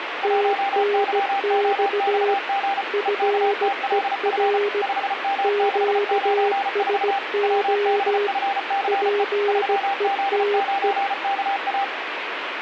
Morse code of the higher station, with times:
0.2-2.8 1YOXG
3.1-4.6 EKTLF
4.8-7.2 5M694
7.4-9.2 WBFCE
9.5-11.8 3Z9KA

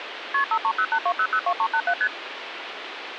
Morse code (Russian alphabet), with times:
none

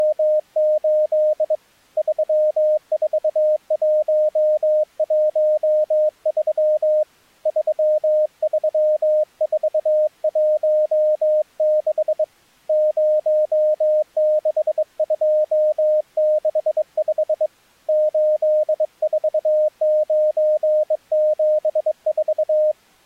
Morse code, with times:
0.0-1.5 …
2.0-7.0 34113
7.5-12.2 33416
12.7-17.5 06265
17.9-22.7 84974

